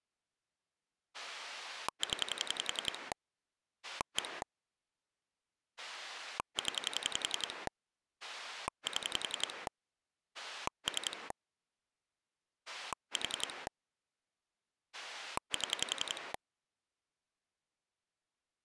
Pulse dialling, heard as a rotary dial, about 11 pulses a second. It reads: 0 1 0 7 3 4 7